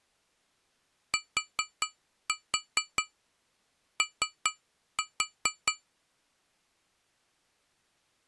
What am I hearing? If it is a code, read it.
Tap code, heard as taps on glass, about 4 knocks a second. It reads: TO